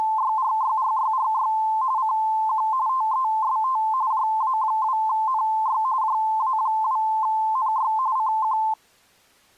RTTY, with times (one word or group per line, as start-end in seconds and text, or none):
0.0-1.5 …
2.0-2.7 CQ
2.9-3.8 TEST
4.1-5.8 JA2NY
6.0-7.9 JA2NY
8.2-8.6 CQ